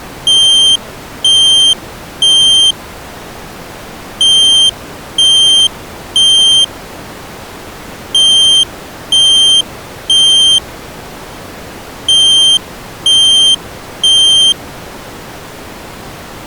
Alarm pattern, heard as an alarm's beeps, played four times, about 3150 Hz. Temporal three. Smoke or fire, evacuate.